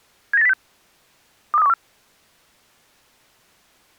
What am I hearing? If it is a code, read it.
Five-tone selective call (EEA), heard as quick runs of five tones, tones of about 40 ms. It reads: 79806 23214